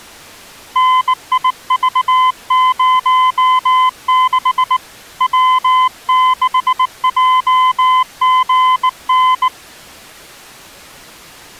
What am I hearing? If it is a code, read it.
Morse code, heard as a keyed tone, hand-sent with a bug key, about 19 wpm, 1020 Hz. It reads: NIV06 W6JGN